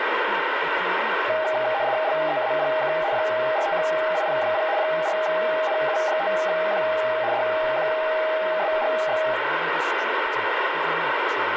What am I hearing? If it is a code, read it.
RTTY (75 baud, 170 Hz shift), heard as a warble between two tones, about 720 Hz centre, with radio static and speech in English. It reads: LEAPK 45IP0 4NU5Q DQSGX